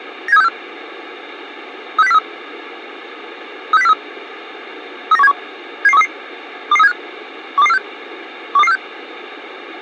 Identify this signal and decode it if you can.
Five-tone selective call (EEA), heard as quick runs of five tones, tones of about 40 ms. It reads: 97364 36043 36043 39171 77133 22375 12246 12246